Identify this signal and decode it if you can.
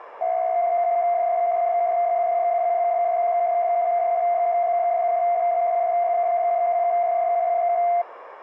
PSK63 (62.5 baud), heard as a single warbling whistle, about 700 Hz, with radio static.